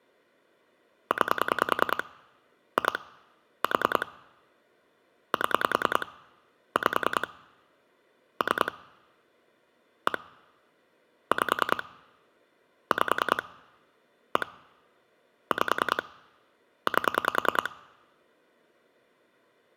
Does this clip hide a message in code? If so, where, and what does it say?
Yes: pulse dialling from 1.1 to 17.7 s, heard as clicks on a phone line, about 10 pulses a second. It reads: 9 2 4 7 5 3 1 5 5 1 5 8